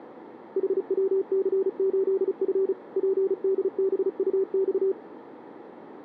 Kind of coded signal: Morse code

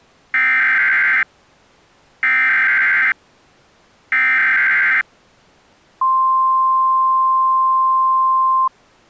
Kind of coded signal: Emergency Alert System (SAME) tones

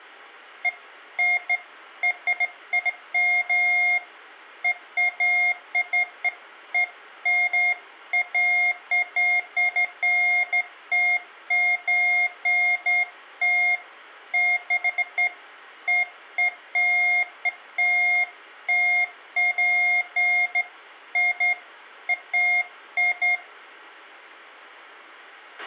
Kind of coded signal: none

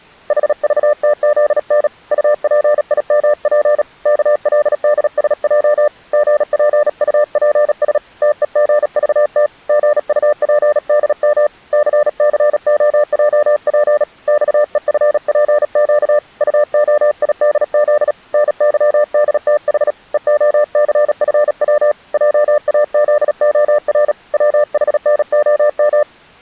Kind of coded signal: Morse code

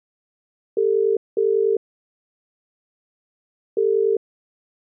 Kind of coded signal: telephone call progress tone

